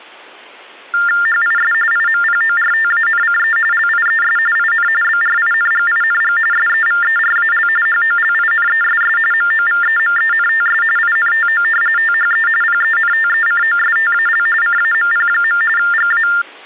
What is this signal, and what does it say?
TTY/TDD text telephone tones (45.45 baud Baudot), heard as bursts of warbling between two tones, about 400 Hz shift, 1600 Hz centre. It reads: HIS IMPORTANCE LIES IN BRINGING SEVERAL HOLINESS MOVEMENTS INTO THE PENTECOSTAL CAMP. GA